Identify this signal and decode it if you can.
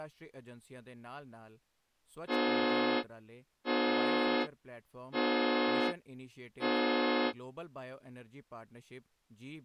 Train horn signal, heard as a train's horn, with speech in Punjabi. 4 short. On North American railways: a request for a signal to be given or repeated.